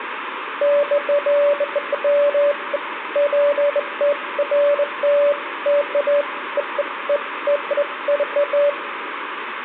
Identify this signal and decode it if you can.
Beeps of irregular length, with phone line noise and room echo. There is no code.